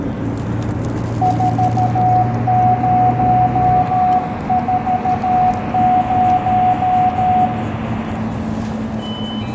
Morse code, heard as a keyed tone, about 13 wpm, 740 Hz, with room echo and the noise inside a bus. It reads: 4040